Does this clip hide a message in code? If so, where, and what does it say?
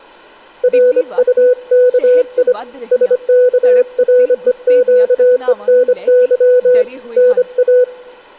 Yes: Morse code (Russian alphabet) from 0.6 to 7.9 s, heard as a keyed tone, hand-sent with a bug key, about 25 wpm, 500 Hz, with room echo and speech in Punjabi. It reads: РУКИ СКРЕЩЕНЫ НА